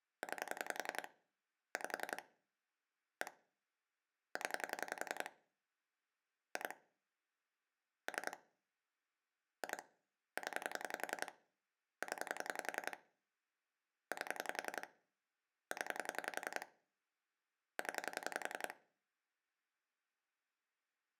Pulse dialling, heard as clicks on a phone line, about 11 pulses a second. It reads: 9 5 1 0 2 3 2 0 0 8 0 0